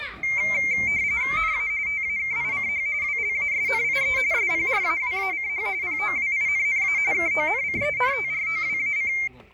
RTTY (45.45 baud, 170 Hz shift), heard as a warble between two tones, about 2200 Hz centre, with the noise of a park. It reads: NA TAKICH WLASNIE SPRAWACH POWINNA KONCENTROWAC